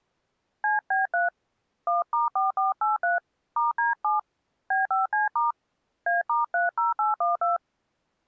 DTMF, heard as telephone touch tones, dialled by hand, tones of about 150 ms. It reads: CB3 1*4483 *D7 B5C* A*30812